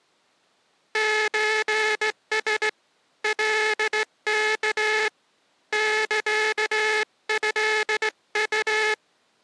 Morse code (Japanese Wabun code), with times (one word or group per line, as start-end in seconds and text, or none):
1.0-2.7 ソラ
3.2-5.1 カワ
5.7-8.9 サトウ